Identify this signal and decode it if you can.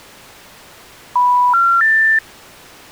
Telephone call progress tone (North American plan), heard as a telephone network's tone, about 980, 1370, 1800 Hz. Special information tone.